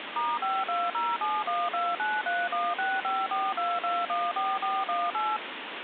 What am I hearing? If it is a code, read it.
DTMF, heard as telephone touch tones, dialled by machine, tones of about 220 ms, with phone line noise. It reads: *5207129316542214418